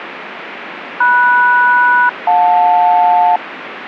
Aircraft SELCAL, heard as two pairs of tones, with radio static. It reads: MS-JL